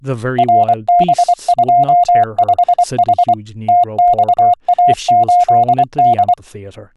Morse code, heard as a keyed tone, machine-sent, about 24 wpm, 710 Hz, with speech in English. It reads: RB25H TXA8D